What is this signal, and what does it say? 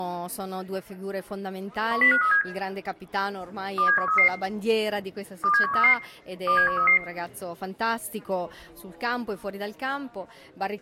Five-tone selective call (CCIR), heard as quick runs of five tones, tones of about 100 ms, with room echo. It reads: 10537 27133 27133 27133